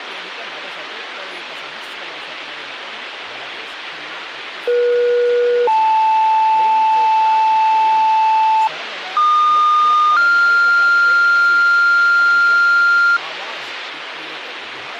Two-tone page, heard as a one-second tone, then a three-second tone, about 480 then 880 Hz, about 1220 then 1400 Hz, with radio hiss and speech in Sanskrit.